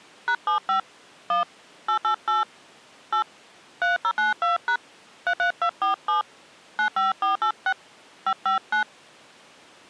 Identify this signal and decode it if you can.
DTMF, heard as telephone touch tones, dialled by hand, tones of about 110 ms. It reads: #75 1 888 8 3092# 33247 95486 559